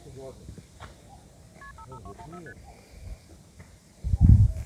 Multi-frequency trunk signalling (R1, as on North American trunks), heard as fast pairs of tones, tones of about 70 ms, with the noise of a park. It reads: KP 55214 ST